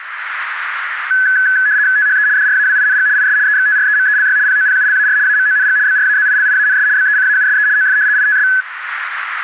RTTY (75 baud, 170 Hz shift), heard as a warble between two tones, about 1600 Hz centre, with radio static. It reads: THE DRAWING IS EXTREMELY POPULAR AMONG BRAZILIANS BECAUSE OF ITS